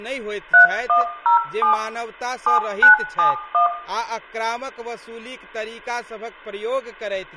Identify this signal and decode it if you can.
DTMF, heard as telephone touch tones, dialled by machine, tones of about 120 ms, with room echo and speech in Maithili. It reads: 3107 7971